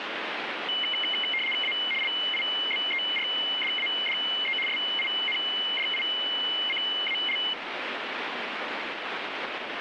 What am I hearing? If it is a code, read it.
RTTY (75 baud, 850 Hz shift), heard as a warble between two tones, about 2550 Hz centre, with radio static. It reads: A LIBERDADE SINDICAL